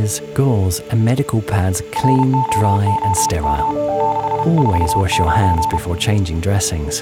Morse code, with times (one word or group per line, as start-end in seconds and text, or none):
2.0-3.7 ROOM
4.0-5.8 649